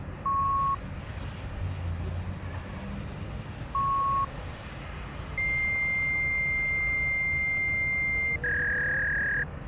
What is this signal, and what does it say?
Fax machine handshake, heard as beeps, a long tone and a warble, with the noise of a residential street.